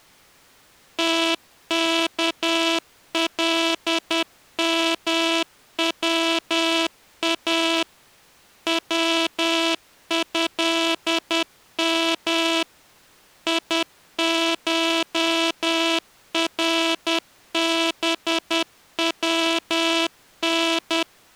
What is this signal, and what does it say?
Morse code (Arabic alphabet), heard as a buzzer, machine-sent, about 10 wpm. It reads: تكلموا وهم يشربون